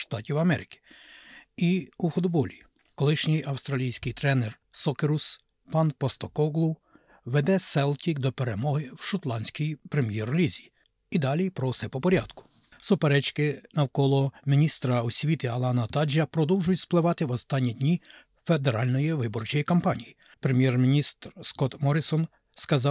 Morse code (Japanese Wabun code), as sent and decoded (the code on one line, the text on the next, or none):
none